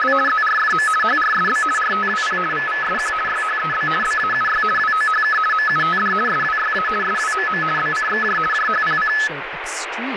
RTTY (50 baud, 450 Hz shift), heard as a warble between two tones, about 1500 Hz centre, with radio static and speech in English. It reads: … ZRFM HRSB RTWP VVSQ YHEB BAUY WOHK MUTD SWYA SWMM BCXJ JHPC